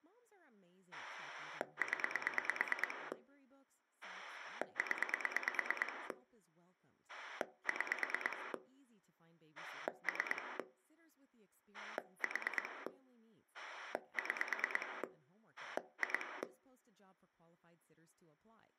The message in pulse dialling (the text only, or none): 0 0 6 3 4 6 2